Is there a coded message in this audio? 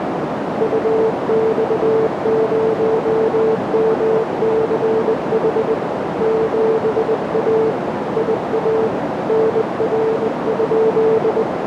Yes: Morse code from 0.5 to 11.5 s, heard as a keyed tone, hand-sent with a bug key, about 20 wpm, 440 Hz, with heavy radio static and a narrow filter. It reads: UX0MCH 7A IA NR?